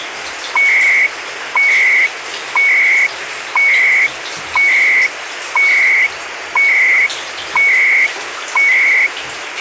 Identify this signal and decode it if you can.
Radio time signal (CHU, Canada), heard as beeps and data bursts, one a second, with radio static and the noise of a restroom.